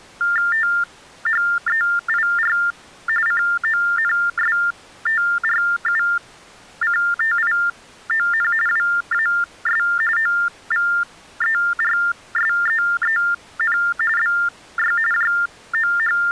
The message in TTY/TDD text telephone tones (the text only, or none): THEIR CONSTRUCTION WAS OVERSEEN BY …